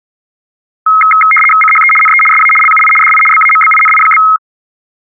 RTTY (75 baud, 850 Hz shift), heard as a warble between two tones, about 1700 Hz centre. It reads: CHE NE SA LUI DI BAMBINI?